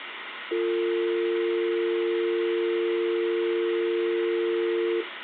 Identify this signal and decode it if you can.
Telephone call progress tone (North American or UK plan), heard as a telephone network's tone, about 350, 450 Hz, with phone line noise. Dial tone.